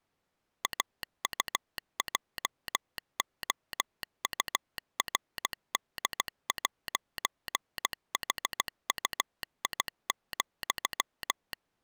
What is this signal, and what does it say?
Morse code, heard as a telegraph sounder, machine-sent, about 16 wpm. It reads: AUJOURD'HUI,